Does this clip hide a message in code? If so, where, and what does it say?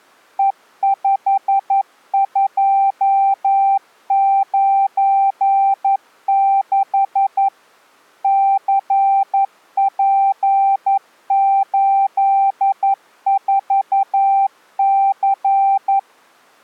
Yes: Morse code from 0.3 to 16.1 s, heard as a keyed tone, machine-sent, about 11 wpm, 780 Hz. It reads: E5296 CP84C